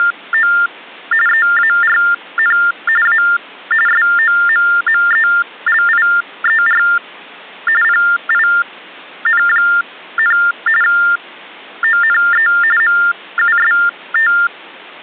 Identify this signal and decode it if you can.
TTY/TDD text telephone tones (45.45 baud Baudot), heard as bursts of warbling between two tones, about 400 Hz shift, 1600 Hz centre. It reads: … EARN A SOMMELIER PIN, ONE MUST